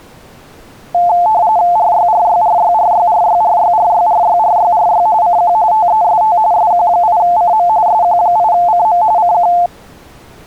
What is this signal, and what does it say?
RTTY (45.45 baud, 170 Hz shift), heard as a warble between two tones, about 790 Hz centre. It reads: RYRYRYRYRYRYRYRYRYRY CQ TEST SQ8CM SQ8CM CQ